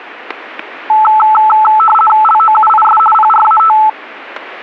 RTTY (50 baud, 450 Hz shift), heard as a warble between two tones, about 1090 Hz centre, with static crashes. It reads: LOUIS PRAT